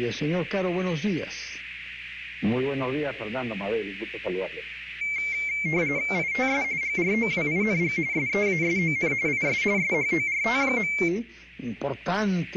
RTTY (45.45 baud, 170 Hz shift), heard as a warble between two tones, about 2200 Hz centre, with radio static. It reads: ITS GROWING SEASON IS SHORT.